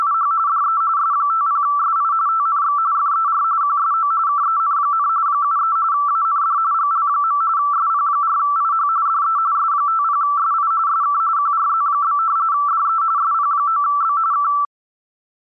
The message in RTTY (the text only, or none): … DE S50SI TNX FER QSO KEN, 73 AND GL. SP4IH DE S50SI SK QRZ? DE SP9B K